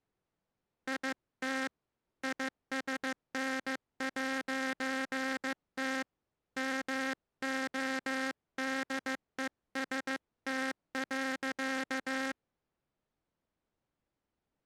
Morse code, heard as a buzzer, hand-sent with a paddle, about 15 wpm. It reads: IT ISN'T MODEST.